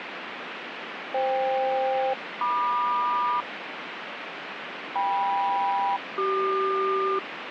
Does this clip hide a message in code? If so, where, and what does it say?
Yes: aircraft SELCAL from 1.1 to 7.2 s, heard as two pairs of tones, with radio static. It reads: FK-MQ KM-CQ